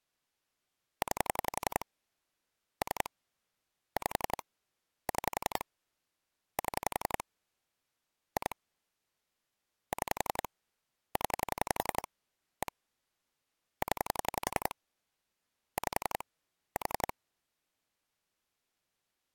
Pulse dialling, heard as clicks on a phone line, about 11 pulses a second. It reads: 9 3 5 6 7 2 6 0 1 0 5 4